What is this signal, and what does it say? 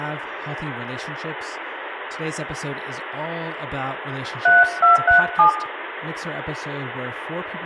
DTMF, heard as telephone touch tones, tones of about 130 ms, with phone line noise, room echo and speech in English. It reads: 3237